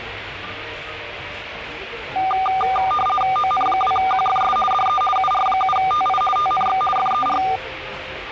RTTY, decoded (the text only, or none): ON2QFS DE UR7TI TNX FER